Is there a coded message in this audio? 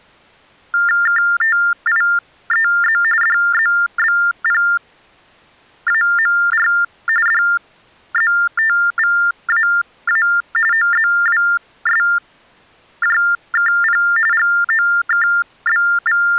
Yes: TTY/TDD text telephone tones (45.45 baud Baudot) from 0.7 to 16.4 s, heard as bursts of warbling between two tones, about 400 Hz shift, 1600 Hz centre. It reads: KTIEZ DZBPAMR DZTVAA OZWSJKP …